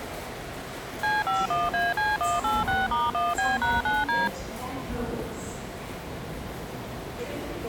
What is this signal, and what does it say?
DTMF, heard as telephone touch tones, dialled by machine, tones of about 190 ms, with the noise of a subway station. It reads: C51AC186*1B#9D